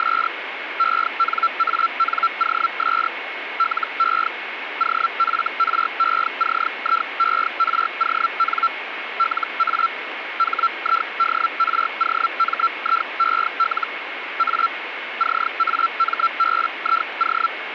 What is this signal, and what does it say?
Hellschreiber (Feld-Hell, 122.5 baud), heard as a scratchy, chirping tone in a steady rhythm, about 1350 Hz, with radio static and a steady whistle near 2180 Hz. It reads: … ENANOS LE OFRECIERON LA HIDROMIEL A CAMBIO